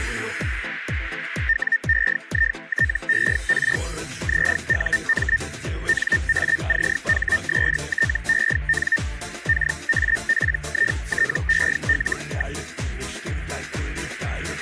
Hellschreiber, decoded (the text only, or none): WEITER ZUM NACHSTEN KAPITEL.